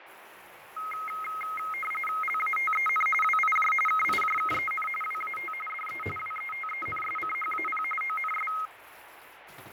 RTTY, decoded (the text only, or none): LATEN WIJ KIJKEN WAT DE WETENSCHAP ONS